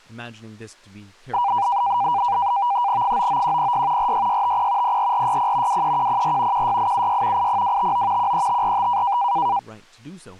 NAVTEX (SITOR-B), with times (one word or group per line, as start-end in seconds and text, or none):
3.0-4.1 99106
4.0-5.0 46650
4.8-5.8 04460
5.7-6.7 23104
6.5-7.5 16876
7.4-8.3 80259
8.2-9.2 13545